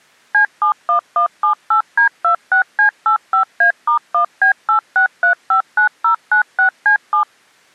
DTMF, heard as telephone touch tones, dialled by machine, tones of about 100 ms. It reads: C71178D26C85A*1B86359096C7